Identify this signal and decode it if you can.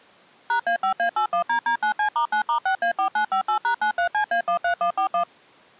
DTMF, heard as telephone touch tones, dialled by machine, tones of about 100 ms. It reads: #A5A81DD9C*9*6A4958#93CA13141